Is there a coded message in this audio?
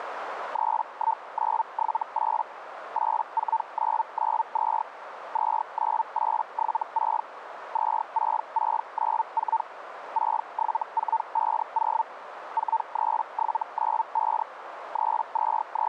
Yes: Hellschreiber (Feld-Hell, 122.5 baud) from 0.5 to 15.9 s, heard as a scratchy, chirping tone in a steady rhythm, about 900 Hz, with radio static and a narrow filter. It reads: 31978 84992 29876 26694 67450 43795 …